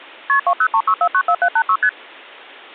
Multi-frequency trunk signalling (R1, as on North American trunks), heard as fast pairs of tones, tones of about 70 ms. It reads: KP 2036494786 ST